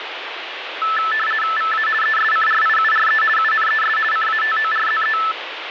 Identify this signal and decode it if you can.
RTTY (50 baud, 450 Hz shift), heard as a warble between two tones, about 1550 Hz centre, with radio static. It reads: VA ESCRIURE UNES CATORZE